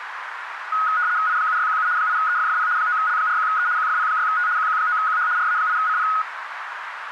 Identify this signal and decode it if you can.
RTTY (75 baud, 170 Hz shift), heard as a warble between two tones, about 1360 Hz centre, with radio static and a narrow filter. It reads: I7617 8EFFP 9L41E QFP6T QQ9QH RA8CP